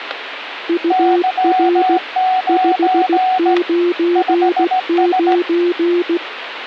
Morse code, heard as two keyed tones, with radio static and static crashes. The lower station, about 16 wpm, 350 Hz: UR 599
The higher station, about 17 wpm, 740 Hz: Y9 5S